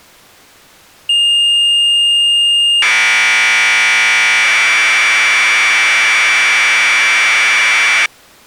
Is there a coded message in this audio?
Yes: Commodore tape loading (standard loader) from 1.1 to 8.1 s, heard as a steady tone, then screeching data.